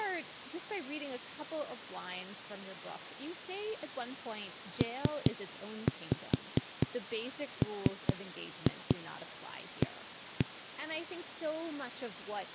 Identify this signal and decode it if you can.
Tap code, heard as knocks on a wall, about 4 knocks a second, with speech in English. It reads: PMA